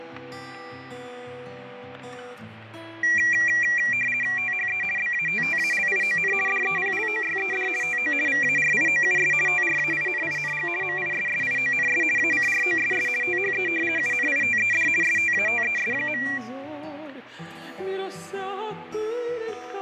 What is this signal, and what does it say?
RTTY (50 baud, 450 Hz shift), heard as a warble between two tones, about 2150 Hz centre, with fading and static crashes. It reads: THE BATTALION DEPLOYED TO VARIOUS TRAINING MISSIONS ACROSS THE UNITED STATES.